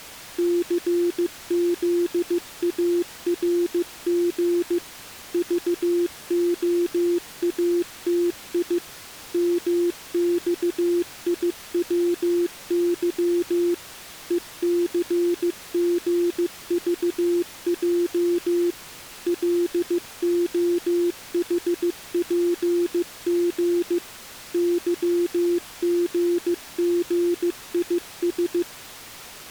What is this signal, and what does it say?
Morse code, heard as a keyed tone, machine-sent, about 15 wpm, 350 Hz. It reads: CZARG VOATI MXIWY ECGVJ LOHPG YGGIS